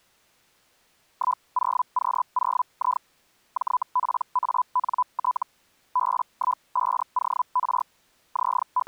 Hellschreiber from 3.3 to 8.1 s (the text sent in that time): JPANT B15OR